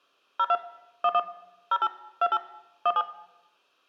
DTMF, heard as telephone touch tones, dialled by machine, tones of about 50 ms, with room echo. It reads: 02 11 08 28 17